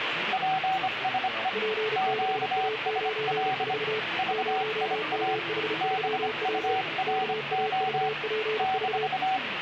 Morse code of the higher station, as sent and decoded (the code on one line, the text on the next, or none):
.--. ... . / --.- ... .-.. / ...- .. .- / -... ..- .-. --- / -....-
PSE QSL VIA BURO -